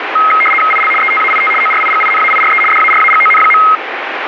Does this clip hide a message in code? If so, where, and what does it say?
Yes: RTTY (75 baud, 850 Hz shift) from 0.2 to 3.8 s, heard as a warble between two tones, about 1700 Hz centre, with radio static. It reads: IL ETAIT ORIGINAIRE DARAGON.